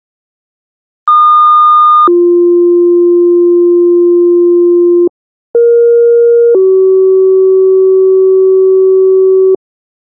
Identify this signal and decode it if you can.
Two-tone page, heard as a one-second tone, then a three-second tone, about 1220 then 350 Hz, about 470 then 380 Hz.